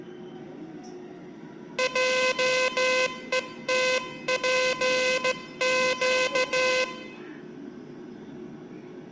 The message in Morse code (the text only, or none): JETPQ